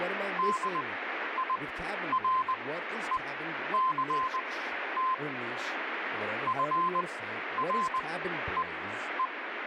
Morse code, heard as a keyed tone, machine-sent, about 20 wpm, spaced as for 11 wpm, 1040 Hz, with radio static and speech in English. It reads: DIRECT FREE